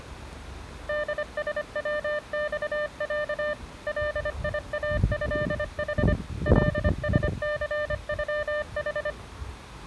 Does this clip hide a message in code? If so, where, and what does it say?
Yes: Morse code (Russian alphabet) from 0.8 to 9.2 s, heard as a keyed tone, machine-sent, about 25 wpm, 600 Hz, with the noise of a residential street. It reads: ДСВЬЯ ЛИАЭХ ЛСЦЮХ